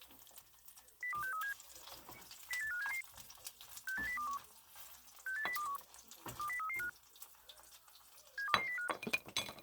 Five-tone selective call (CCIR), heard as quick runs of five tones, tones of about 100 ms, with kitchen noise. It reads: 02637 08577 68021 68021 20335 72205